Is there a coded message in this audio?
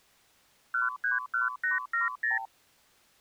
Yes: multi-frequency trunk signalling (R2, with the far end's replies) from 0.7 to 2.5 s, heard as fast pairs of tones, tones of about 150 ms. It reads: 131870